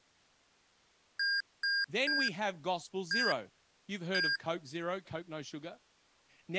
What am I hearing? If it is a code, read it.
Beep code, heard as beeps from a small speaker, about 1600 Hz, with speech in English. 3-1-1. In Phoenix BIOS tables: DMA register failure.